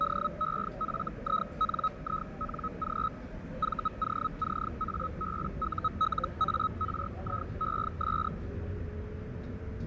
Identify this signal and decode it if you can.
Hellschreiber (Feld-Hell, 122.5 baud), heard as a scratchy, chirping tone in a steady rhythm, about 1280 Hz, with radio static, fading and the noise inside a subway train. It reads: DEFINING VOCABULARIES